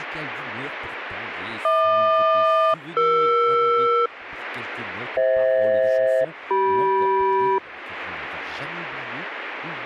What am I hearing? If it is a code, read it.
Aircraft SELCAL, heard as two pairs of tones. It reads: HQ-ER FH-CM